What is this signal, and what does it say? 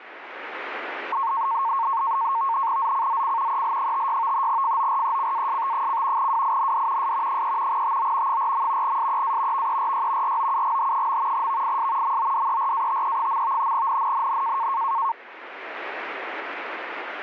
NAVTEX (SITOR-B), 100 baud, 170 Hz shift, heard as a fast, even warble, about 1000 Hz centre, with radio static. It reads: ZCZC EL56 FORECAST: WIND S 3 TO 4. SEA VERY ROUGH. VIS MODERATE. NNNN